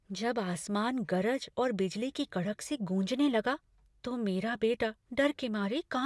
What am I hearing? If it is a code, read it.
Speech in Hindi. There is no code.